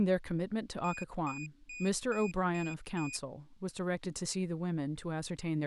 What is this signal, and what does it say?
Beep code, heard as a piezo beeper, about 2450 Hz, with speech in English. 6 short. In AMI BIOS tables: keyboard controller gate A20 failure; in Dell tables: video card failure.